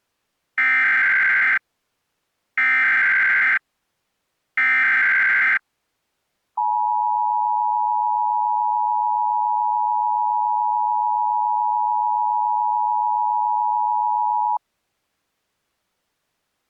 Emergency Alert System (SAME) tones (header bursts, then the 853 and 960 Hz attention tone), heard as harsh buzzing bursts, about 520.83 baud.